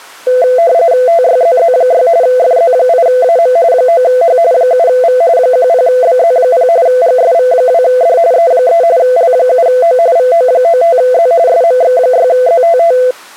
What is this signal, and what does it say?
RTTY (45.45 baud, 170 Hz shift), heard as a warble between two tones, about 590 Hz centre. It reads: TYZZ6 FZ8AM 9H 7V 10BZ0 GSV2D E3 L7O VO95Z SMX6ZTT